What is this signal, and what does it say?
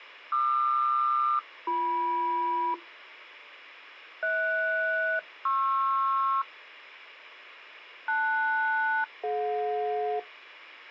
Aircraft SELCAL, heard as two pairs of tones. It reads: QR-BM HS-PR LS-DJ